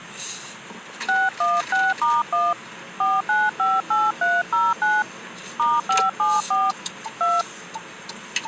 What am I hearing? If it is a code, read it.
DTMF, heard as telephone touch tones, dialled by hand, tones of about 210 ms, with the noise inside a car. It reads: 616*1 4958309 *574 2